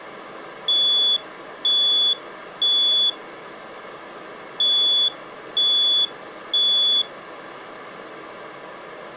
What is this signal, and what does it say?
Alarm pattern, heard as an alarm's beeps, played twice, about 3450 Hz. Temporal three. Smoke or fire, evacuate.